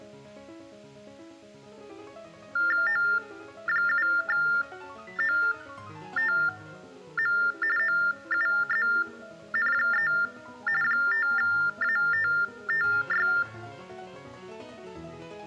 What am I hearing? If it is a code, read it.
TTY/TDD text telephone tones (45.45 baud Baudot), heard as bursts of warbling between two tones, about 400 Hz shift, 1600 Hz centre. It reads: O7OTM OUZN3 5ATTY